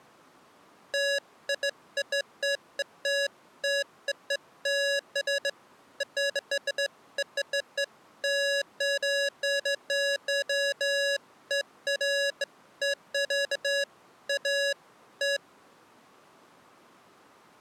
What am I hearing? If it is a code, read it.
Beeps of irregular length. There is no code.